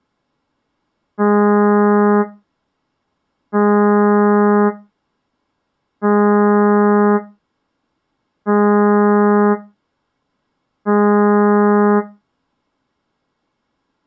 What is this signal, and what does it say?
Ship horn signal, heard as a ship's horn, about 210 Hz. 5 short. At sea: I doubt that you are doing enough to avoid a collision.